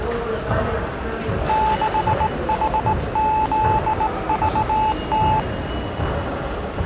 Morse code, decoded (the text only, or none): 6HZVT